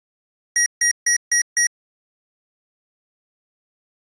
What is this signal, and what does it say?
Beep code, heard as beeps from a small speaker, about 1900 Hz. 5 short. In AMI BIOS tables: processor failure; in Dell tables: CMOS battery failure.